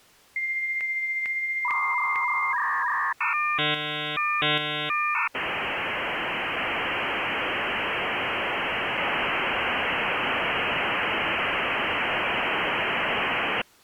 Dial-up modem handshake (V.34 or later), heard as a whistle, warbles, then hiss.